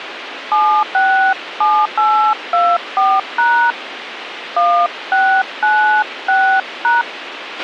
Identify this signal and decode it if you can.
DTMF, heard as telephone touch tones, dialled by hand, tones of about 280 ms, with radio hiss and a squelch burst at the end. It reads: 767824# 1696#